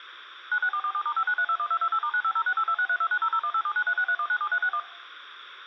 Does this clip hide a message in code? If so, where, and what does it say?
Yes: DTMF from 0.5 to 4.8 s, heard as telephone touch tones, dialled by machine, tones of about 70 ms. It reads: 96447*59321228*9506826329001879363197361